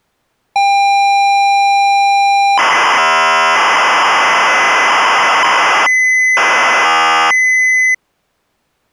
ZX Spectrum tape loading, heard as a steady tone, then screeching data.